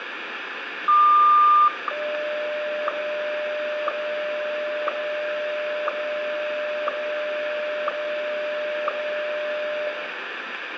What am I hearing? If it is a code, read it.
Radio time signal (WWVH, Hawaii), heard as ticks, one a second, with radio static and room echo.